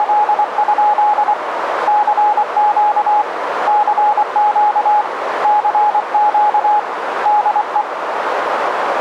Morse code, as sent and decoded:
… / -.-. --.- / -.-. --.- / -.-. --.- / -.. .
… CQ CQ CQ DE

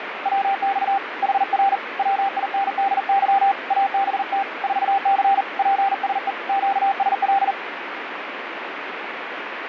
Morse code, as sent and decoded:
.-- -..- / .... .-. / .-- .. -. -.. -.-- / .- -... - / ....- -.-. / .--. ... . / --.- ... .-..
WX HR WINDY ABT 4C PSE QSL

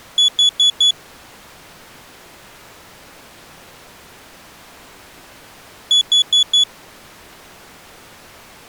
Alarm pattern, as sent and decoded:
4 beeps and a pause
temporal four

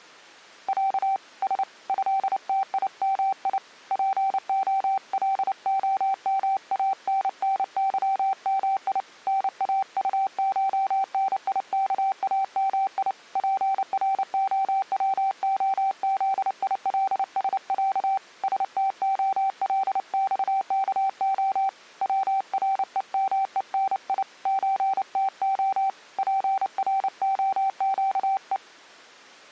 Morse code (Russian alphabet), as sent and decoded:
.-.- / ... / ..-.. - .. -- .. / .--. --- .-.. --- -- .- -. -. -.-- -- .. / -. .- ..- ---- -. .. -.- .- -- .. / .--. .-. --- .-- --- --.. .. .-.. ... .-.- / ... - --- .-.. -..- -.- --- / .-- .-. . -- . -. .. / ---. - --- / .--. .-. --- --.- .
Я С ЭТИМИ ПОЛОМАННЫМИ НАУШНИКАМИ ПРОВОЗИЛСЯ СТОЛЬКО ВРЕМЕНИ ЧТО ПРОЩЕ

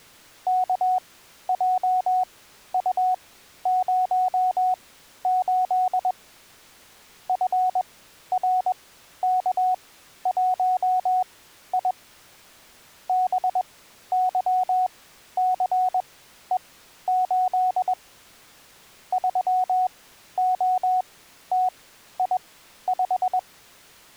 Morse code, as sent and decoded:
-.- .--- ..- ----- ---.. / ..-. .-. -.- .---- .. / -... -.-- -.-. . ---.. / ...-- --- - .. .....
KJU08 FRK1I BYCE8 3OTI5

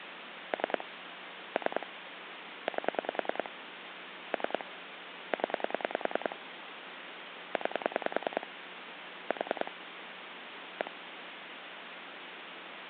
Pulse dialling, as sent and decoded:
3 / 3 / 8 / 3 / 10 / 9 / 4 / 1
3 3 8 3 0 9 4 1

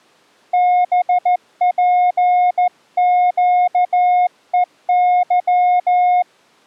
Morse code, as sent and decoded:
-... .--. --.- . -.--
BPQEY

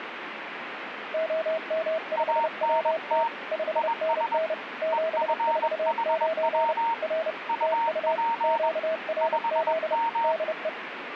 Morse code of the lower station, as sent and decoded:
--- -- ..... .-- - / ..... -. -. / --... ....- ----. / .-. / - ..- / --.- .-. --.. / -.. .
OM5WT 5NN 749 R TU QRZ DE

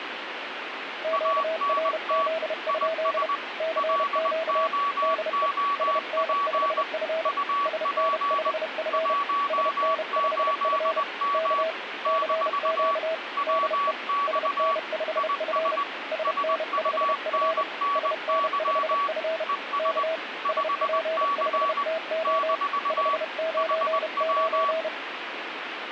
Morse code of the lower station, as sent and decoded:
--.- .-. --.. ..--.. / -.-. --.- / -.. . / ... -. ..... ..-. / ... -. ..... ..-. / ... -. ..... ..-. / -.- / -.-. --.- / -.. . / ... -. ..... ..-. / ... -. ..... ..-. / ... -. ..... ..-. / -.- / ... .--. ..... - --- / ..... ----. ----.
QRZ? CQ DE SN5F SN5F SN5F K CQ DE SN5F SN5F SN5F K SP5TO 599

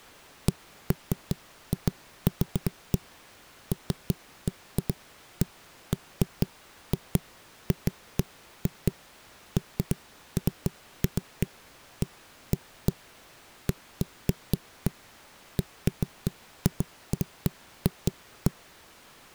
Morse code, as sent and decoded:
none

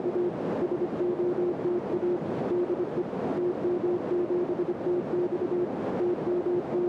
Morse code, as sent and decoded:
… / ... --- - .- / -.. . / - -- --... - -..- / …
… SOTA DE TM7TX …

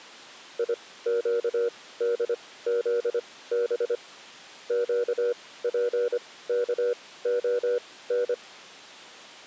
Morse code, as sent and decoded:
.. --.- -.. --.. -... / --.- .--. -.- --- -.
IQDZB QPKON

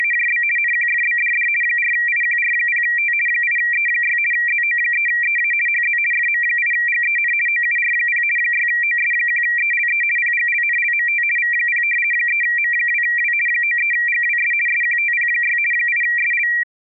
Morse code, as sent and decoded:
none

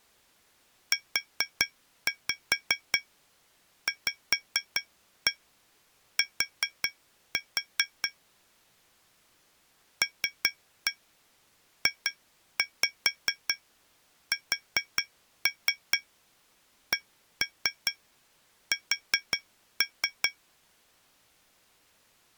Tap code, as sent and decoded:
4-5 5-1 4-4 / 3-1 2-5 4-3 1-3 4-3
UVT LJSCS

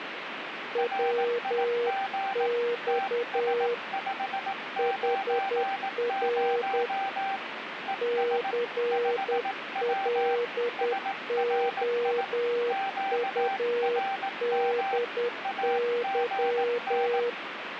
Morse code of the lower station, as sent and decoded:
.-- -..- / .... .-. / -.-. .-.. --- ..- -.. -.--
WX HR CLOUDY

